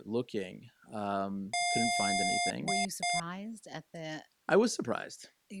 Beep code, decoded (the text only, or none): 1 long, 2 short